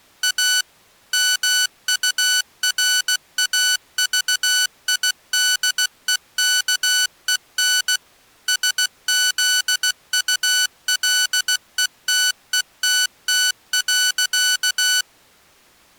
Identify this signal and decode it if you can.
Morse code, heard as electronic beeps, machine-sent, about 16 wpm, 1490 Hz. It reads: A MURAVIDEKEN SZULETETT.